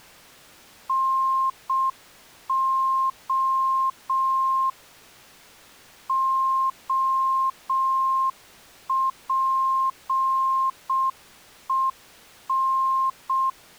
Morse code, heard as a keyed tone, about 6 wpm, 1060 Hz. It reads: NO OPEN